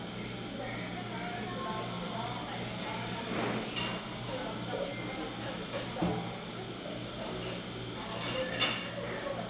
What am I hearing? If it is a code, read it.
The noise of a cafe. There is no code.